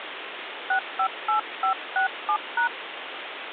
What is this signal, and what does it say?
DTMF, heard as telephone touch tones, dialled by hand, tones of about 100 ms, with phone line noise. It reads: 658567#